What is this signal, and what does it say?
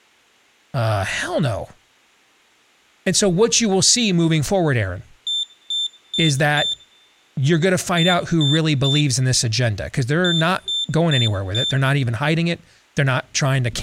Beep code, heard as a piezo beeper, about 3550 Hz, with room echo and speech in English. 4-3-4. In Phoenix BIOS tables: time-of-day clock failure.